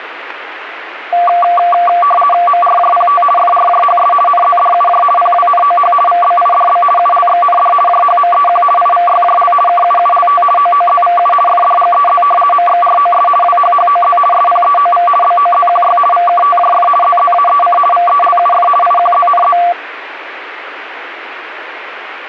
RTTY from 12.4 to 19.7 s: MXROS WHHOZ SPEOV BOZQY VKTJF ZZAEC VELUF IQZNZ

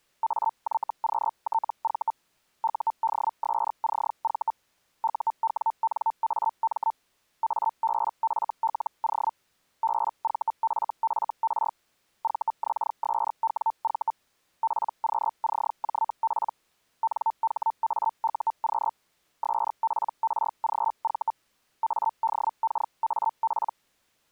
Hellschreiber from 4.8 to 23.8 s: UWNAM ABFLO BVFFR VXSWV PQCJP NHAUQ SPRGV ADKAP

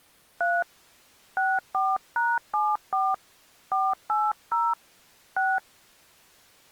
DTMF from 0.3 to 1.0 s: 3

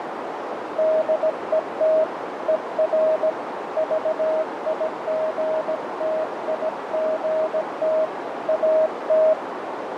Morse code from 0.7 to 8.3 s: DET ER VIGTIGT

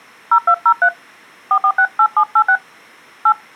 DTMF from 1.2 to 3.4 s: 4468786 8

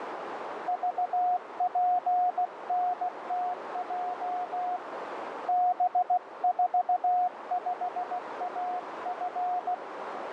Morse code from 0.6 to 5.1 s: VPNTJ

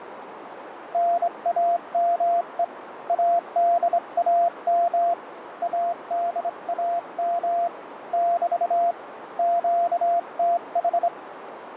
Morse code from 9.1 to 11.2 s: QTH

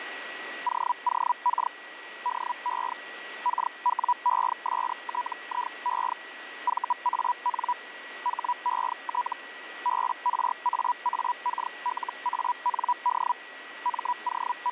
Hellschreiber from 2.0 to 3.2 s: DE

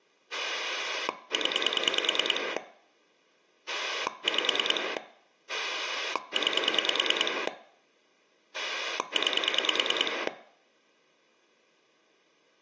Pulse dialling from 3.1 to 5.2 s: 5

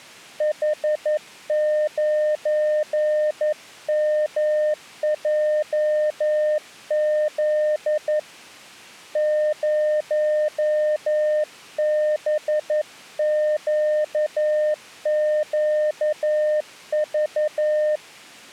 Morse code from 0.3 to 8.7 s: H9MJZ

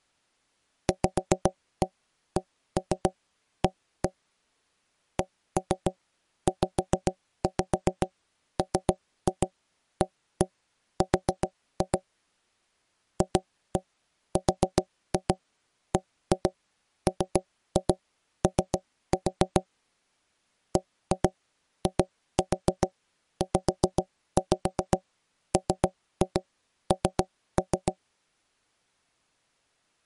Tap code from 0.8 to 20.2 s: VCA CZMAR FRBMO

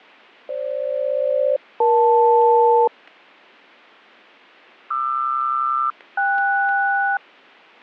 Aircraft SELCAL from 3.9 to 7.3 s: QR-KS

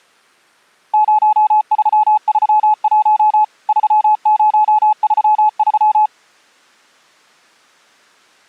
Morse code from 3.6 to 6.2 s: 3033

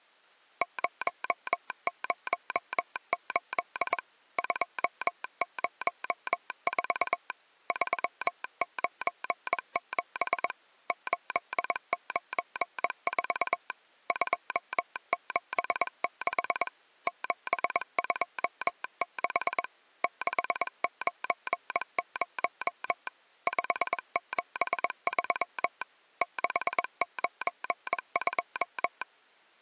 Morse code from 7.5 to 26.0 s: 397 894 276 726 690 573

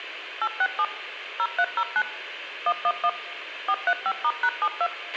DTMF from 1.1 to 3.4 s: 0309 111

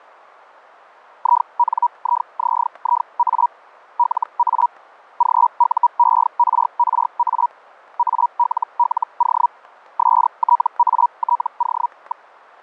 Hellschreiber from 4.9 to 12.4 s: GUERRA ALLO STATO.

